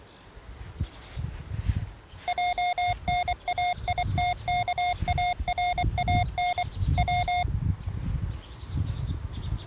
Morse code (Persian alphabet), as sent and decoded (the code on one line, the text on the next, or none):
.--- -. .- .. - -.- .- .-. .- -. / .--
جنایتکاران و